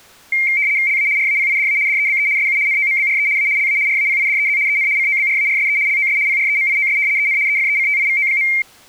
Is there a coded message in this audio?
Yes: RTTY (75 baud, 170 Hz shift) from 0.3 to 8.6 s, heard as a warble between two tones, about 2200 Hz centre. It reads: LA RAPIDA DEBE SU NOMBRE A LA RAPIDEZ EN COBRARSE LOS PREMIOS EN EFECTIVO.